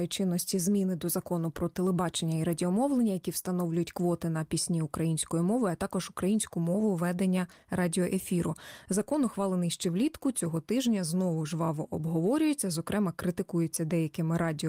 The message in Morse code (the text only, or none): none